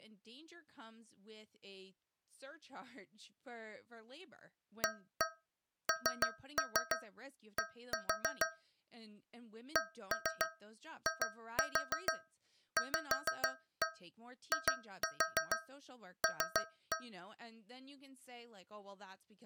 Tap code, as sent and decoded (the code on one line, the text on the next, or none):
1-1 3-3 1-4 / 1-3 2-4 5-1 2-4 3-1
AND CIVIL